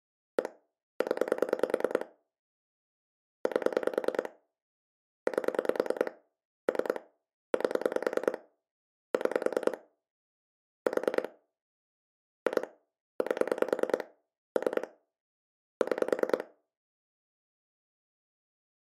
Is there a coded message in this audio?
Yes: pulse dialling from 0.4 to 16.4 s, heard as clicks on a phone line, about 10 pulses a second. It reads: 1 0 8 8 3 8 6 4 2 8 3 6